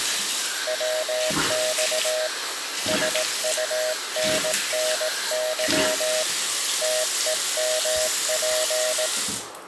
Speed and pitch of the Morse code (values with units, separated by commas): 18 wpm, 630 Hz